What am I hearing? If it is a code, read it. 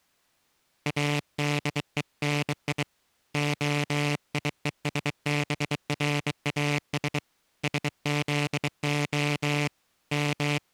Morse code (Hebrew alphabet), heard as a buzzer, hand-sent with a bug key, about 23 wpm. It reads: אדוני היושבראש שזה …